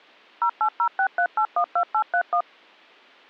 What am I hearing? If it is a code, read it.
DTMF, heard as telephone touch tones, dialled by machine, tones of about 80 ms. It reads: 08063812831